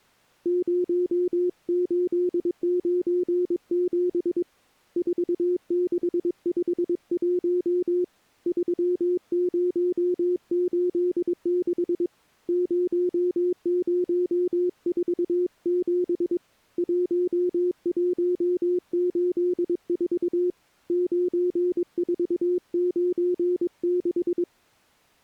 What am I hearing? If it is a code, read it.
Morse code, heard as a keyed tone, hand-sent with a paddle, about 22 wpm, 360 Hz. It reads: 0897 4651 3086 0047 1184 9496